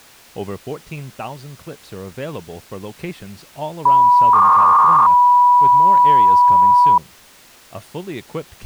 300-baud modem data (V.21 tones), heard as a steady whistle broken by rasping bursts, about 300 baud, 200 Hz shift, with speech in English.